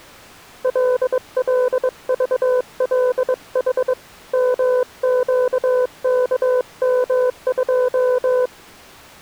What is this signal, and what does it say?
Morse code, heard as a keyed tone, hand-sent with a bug key, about 22 wpm, 500 Hz. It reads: LLVLH MQKM2